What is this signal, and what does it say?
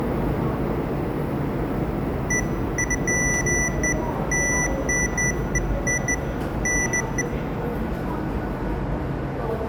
Beeps of irregular length, with the noise of a subway station. There is no code.